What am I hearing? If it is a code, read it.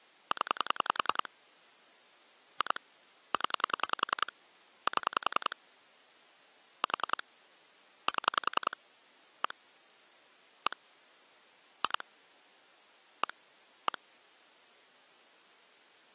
Pulse dialling, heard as clicks on a phone line, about 10 pulses a second. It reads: 0 2 0 7 4 7 1 1 2 1 1